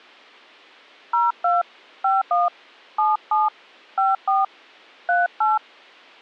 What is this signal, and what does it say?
DTMF, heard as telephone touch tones, dialled by hand, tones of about 180 ms. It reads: 02 51 77 54 38